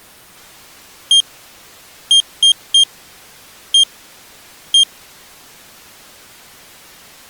Beep code, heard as a piezo beeper, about 3200 Hz. 1-3-1-1. In Phoenix BIOS tables: memory refresh test failure.